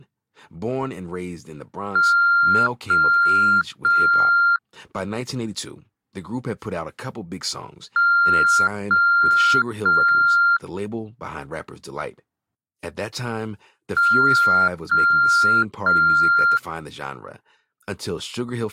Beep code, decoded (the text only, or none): 3 long